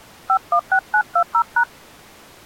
DTMF, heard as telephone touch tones, dialled by hand, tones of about 80 ms. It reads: 516920#